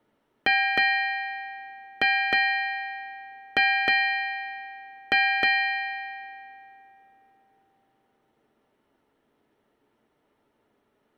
Ship's bell, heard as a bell. 8. Eight half-hours of the watch have passed.